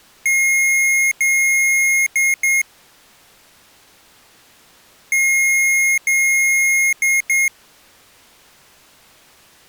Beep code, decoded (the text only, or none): 2 long, 2 short